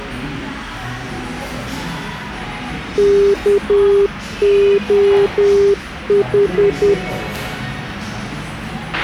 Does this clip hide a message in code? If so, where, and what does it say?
Yes: Morse code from 2.9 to 7.0 s, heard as a keyed tone, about 10 wpm, 400 Hz, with a squelch burst at the end and the noise of a cafe. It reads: KOH